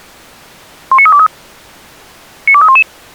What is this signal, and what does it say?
Five-tone selective call (ZVEI), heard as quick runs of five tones, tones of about 70 ms. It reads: 19323 92311